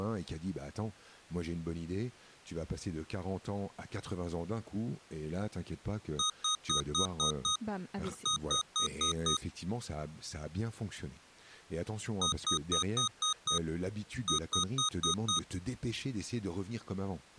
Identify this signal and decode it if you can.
Beep code, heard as beeps from a small speaker, played twice, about 1250 Hz, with speech in French. 6-5.